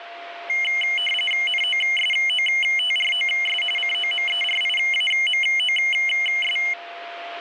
RTTY (45.45 baud, 850 Hz shift), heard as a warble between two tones, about 2550 Hz centre, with radio static and a steady whistle near 690 Hz. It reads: NOSOTROS COMERIAMOS